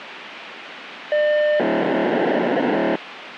POCSAG pager data (1200 baud), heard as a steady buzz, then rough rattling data, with radio hiss.